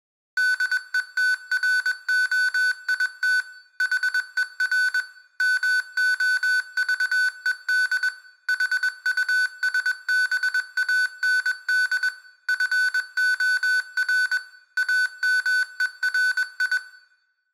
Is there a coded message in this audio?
Yes: Morse code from 0.3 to 16.8 s, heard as electronic beeps, machine-sent, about 21 wpm, 1500 Hz, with room echo. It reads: DETROIT HER MOVED HUSBAND FOR AMERI